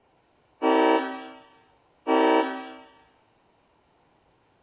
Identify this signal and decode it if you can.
Train horn signal, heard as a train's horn, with room echo. 2 short. On North American railways: a signal is acknowledged.